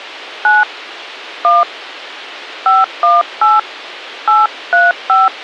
DTMF, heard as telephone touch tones, dialled by hand, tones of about 180 ms. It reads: 9 1 518 835